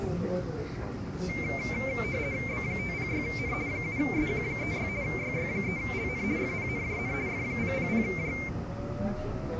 RTTY (50 baud, 170 Hz shift), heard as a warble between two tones, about 2200 Hz centre, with the noise inside a subway train. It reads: B506N 7SQ36 YY3LN FPNJN F000J